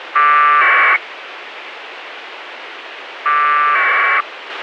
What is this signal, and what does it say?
Packet radio (AX.25, as in APRS), 1200 baud, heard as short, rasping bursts, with radio hiss and a squelch burst at the end.